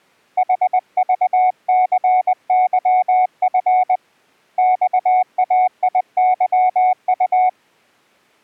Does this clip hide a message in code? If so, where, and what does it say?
Yes: Morse code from 0.3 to 7.6 s, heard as a keyed tone, hand-sent with a paddle, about 20 wpm, 740 Hz. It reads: HVCYF XAIYU